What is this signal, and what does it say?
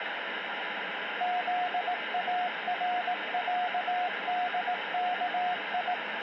Morse code (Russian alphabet), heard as a keyed tone, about 18 wpm, 720 Hz, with radio static. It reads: ЗАРЯДКИ